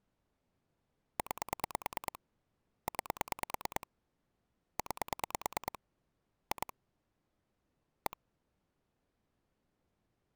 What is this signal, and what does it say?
Pulse dialling, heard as clicks on a phone line, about 9 pulses a second. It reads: 9 9 9 2 1